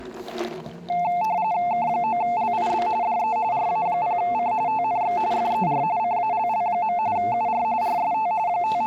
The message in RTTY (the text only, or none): K9LIB DE RA0C TNX FER CALL. UR RST …